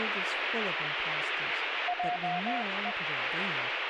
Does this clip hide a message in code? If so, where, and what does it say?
Yes: Morse code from 1.8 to 3.0 s, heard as a keyed tone, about 21 wpm, 720 Hz, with heavy radio static and speech in English. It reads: JE